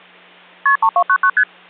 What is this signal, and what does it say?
Multi-frequency trunk signalling (R1, as on North American trunks), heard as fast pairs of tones, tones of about 70 ms, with hum. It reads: KP 3299 ST